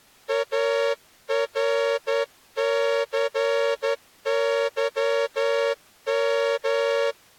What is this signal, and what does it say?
Morse code, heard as a horn, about 11 wpm. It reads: ARCYM